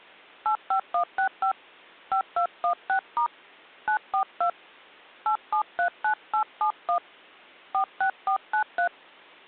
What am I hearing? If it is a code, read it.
DTMF, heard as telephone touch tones, dialled by hand, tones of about 90 ms. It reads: 85165 5216* 942 8739871 46493